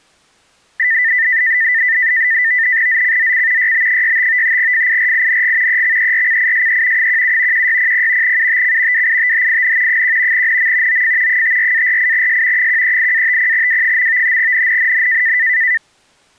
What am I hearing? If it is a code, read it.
NAVTEX (SITOR-B), 100 baud, 170 Hz shift, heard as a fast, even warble, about 1900 Hz centre. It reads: ZCZC YB65 FIRING EXERCISE 17 1600 UTC WITHIN 1 NM OF 54-48S 138-50W. NNNN